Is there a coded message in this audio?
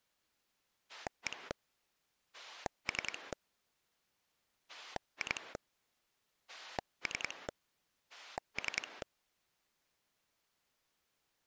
Yes: pulse dialling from 0.9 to 9.0 s, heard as a rotary dial, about 10 pulses a second. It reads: 1 3 2 3 3